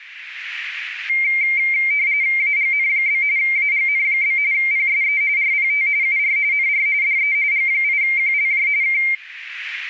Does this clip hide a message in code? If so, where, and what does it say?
Yes: RTTY (45.45 baud, 170 Hz shift) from 1.1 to 9.1 s, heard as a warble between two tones, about 2200 Hz centre. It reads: AGN? AGN? PSE RPT UR NR DE G8QLJ K